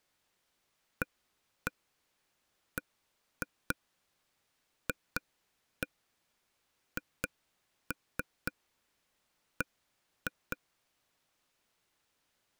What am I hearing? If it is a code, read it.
Tap code, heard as taps on a table, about 4 knocks a second. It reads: ABFHB